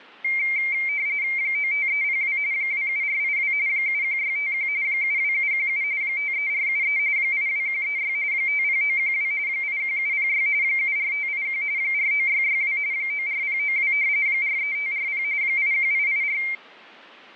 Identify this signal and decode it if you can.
RTTY (45.45 baud, 170 Hz shift), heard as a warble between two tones, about 2200 Hz centre. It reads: 95302 27482 71651 72717 53473 82136 50912 81706 74581 49662 94092 43540 81884